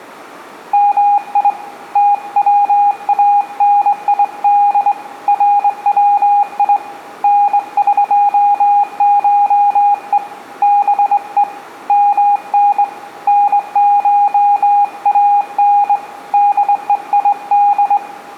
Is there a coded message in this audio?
Yes: Morse code (Persian alphabet) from 0.7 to 18.0 s, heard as a keyed tone, hand-sent with a straight key, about 21 wpm, 820 Hz, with room echo. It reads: می توانید روی نقشه به من نشان دهید